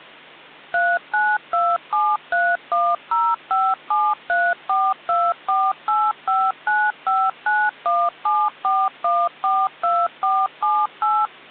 DTMF, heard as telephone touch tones, dialled by machine, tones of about 230 ms. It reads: 392731057342485959174142478